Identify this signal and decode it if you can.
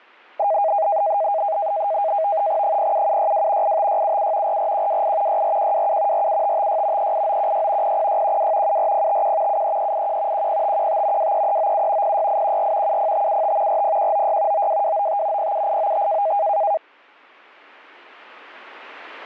NAVTEX (SITOR-B), 100 baud, 170 Hz shift, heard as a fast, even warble, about 720 Hz centre, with static crashes. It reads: 07762 85677 44128 64127 47556 38916 00612 74051 73381 10515 23397 06814 70575 40196 92295 07895